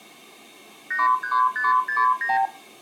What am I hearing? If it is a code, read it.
Multi-frequency trunk signalling (R2, with the far end's replies), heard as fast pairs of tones, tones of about 160 ms. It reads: 83569